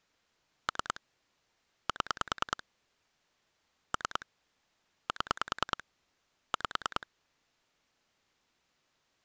Pulse dialling, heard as clicks on a phone line, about 10 pulses a second. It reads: 3 7 3 7 5